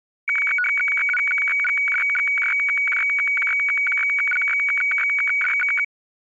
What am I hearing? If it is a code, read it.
Weather fax (radiofax), 120 lines a minute, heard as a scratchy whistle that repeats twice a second.